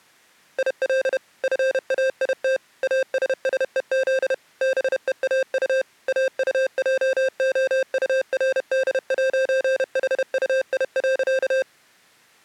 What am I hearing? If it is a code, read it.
Morse code, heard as electronic beeps, machine-sent, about 31 wpm, 530 Hz. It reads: IL FAIT ASSEZ BEAU AUJOURD'HUI.